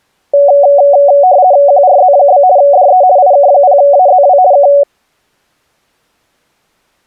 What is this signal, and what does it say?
RTTY (50 baud, 170 Hz shift), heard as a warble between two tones, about 650 Hz centre. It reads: QRZ? DE IK0AZW K